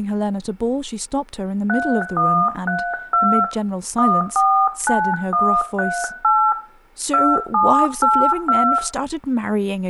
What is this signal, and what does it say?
DTMF, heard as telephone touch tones, dialled by hand, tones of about 280 ms, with room echo and speech in English. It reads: 3132 149138 2782